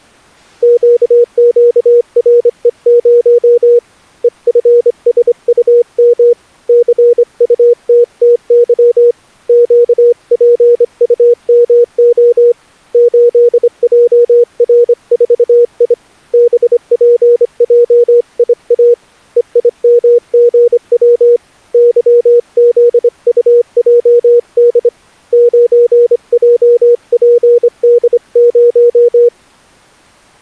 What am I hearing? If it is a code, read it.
Morse code, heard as a keyed tone, hand-sent with a straight key, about 25 wpm, 480 Hz. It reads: QQRE0 EFSUM CUTTY QPUMO 8JR4I BPJIA EIMGW YZUJD 9JPD0